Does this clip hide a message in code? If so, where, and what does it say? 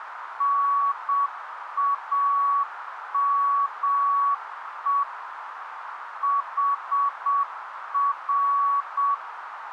Yes: Morse code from 0.3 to 9.2 s, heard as a keyed tone, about 7 wpm, 1130 Hz, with radio static and a narrow filter. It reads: NAME HR